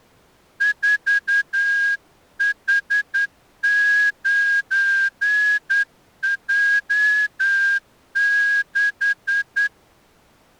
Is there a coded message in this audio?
Yes: Morse code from 0.5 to 9.7 s, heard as a whistle, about 10 wpm. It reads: 4H9J6